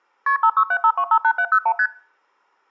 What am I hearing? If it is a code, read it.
Multi-frequency trunk signalling (R1, as on North American trunks), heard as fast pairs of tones, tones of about 70 ms. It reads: KP 5675258701 ST